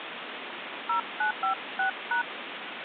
DTMF, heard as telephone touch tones, dialled by hand, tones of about 110 ms, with phone line noise. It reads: 0956#